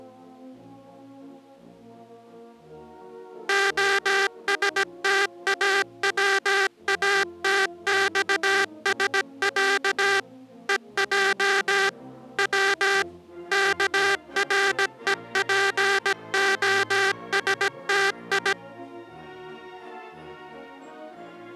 Morse code (Russian alphabet), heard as a buzzer, machine-sent, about 17 wpm. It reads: ОСТАВАТЬСЯ ЕЙ В КРЕПОСТИ